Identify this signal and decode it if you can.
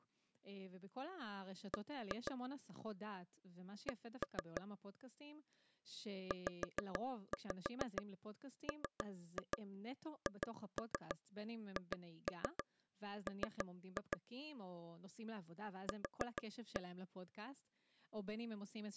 Tap code, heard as taps on a table, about 6 knocks a second, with speech in Hebrew. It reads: B C ZMHHM Q